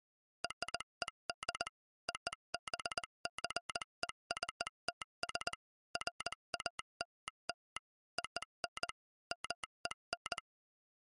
Morse code (American railroad code), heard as a telegraph sounder, machine-sent. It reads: RED OBJECTS FALL ON MEN